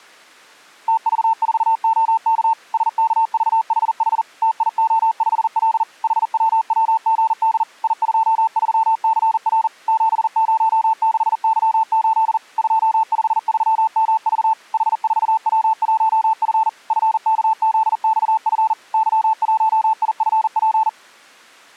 Morse code, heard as a keyed tone, machine-sent, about 40 wpm, 890 Hz. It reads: TV4OK SKVHH TIO5L HWWGD I23CR 706Y8 253MV H4W1F FKZXF Y1IFP